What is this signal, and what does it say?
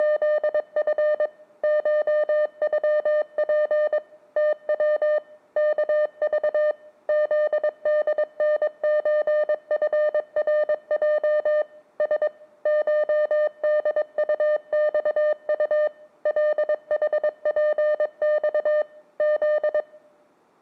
Morse code (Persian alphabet), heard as a keyed tone, machine-sent, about 22 wpm, 600 Hz. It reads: … شغپ تو کذ زدنچفرج س شدطخط لحپخ ز